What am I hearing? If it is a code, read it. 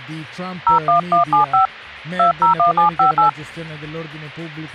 DTMF, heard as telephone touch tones, dialled by hand, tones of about 120 ms. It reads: 01175 201758